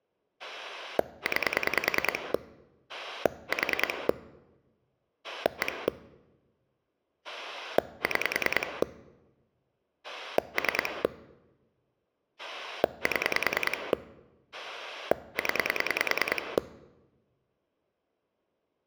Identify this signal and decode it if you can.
Pulse dialling, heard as a rotary dial, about 10 pulses a second. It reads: 9 4 1 6 3 7 0